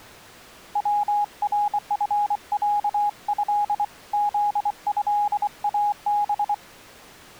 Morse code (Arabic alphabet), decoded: ورفعه ذهاب

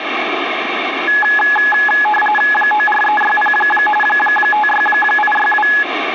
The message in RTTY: 94360 56862

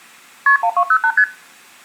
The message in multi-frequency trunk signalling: KP 1208 ST

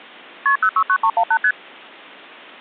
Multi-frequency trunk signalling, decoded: KP 069318 ST

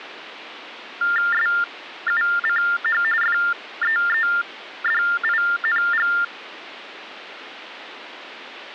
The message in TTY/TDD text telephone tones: SUCH FEEDING

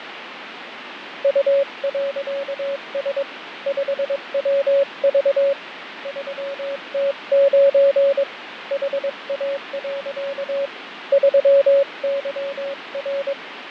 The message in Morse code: U.S 5WV 3T9 HA. 3YR

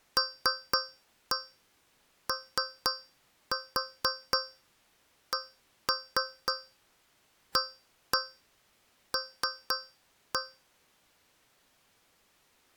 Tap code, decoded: LOCAL

